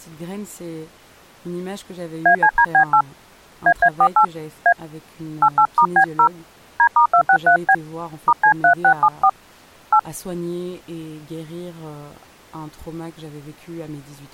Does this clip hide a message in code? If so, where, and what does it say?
Yes: DTMF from 2.3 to 10.0 s, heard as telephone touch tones, dialled by hand, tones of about 80 ms, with speech in French. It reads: ACDB8 AA48 A 88*B0 D*263B *C3674 8